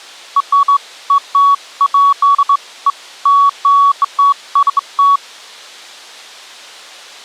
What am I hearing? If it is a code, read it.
Beeps of irregular length. There is no code.